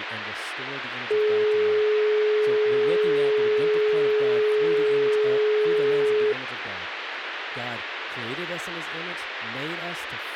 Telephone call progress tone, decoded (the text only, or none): dial tone